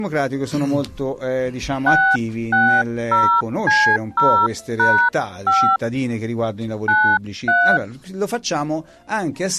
DTMF, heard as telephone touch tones, dialled by hand, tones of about 300 ms. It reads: 660C0#5 93